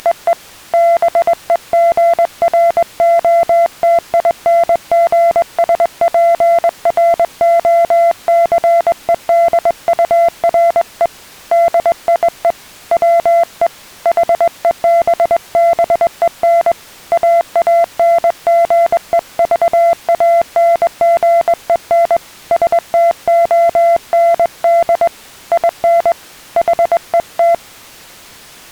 Morse code, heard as a keyed tone, hand-sent with a straight key, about 21 wpm, 680 Hz. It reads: … BEGROTINGSPROCEDURE DIE WE HEBBEN AANGEVANGEN STOND IN HET